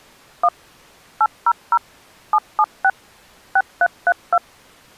DTMF, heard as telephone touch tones, dialled by machine, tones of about 50 ms. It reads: 1 800 776 6332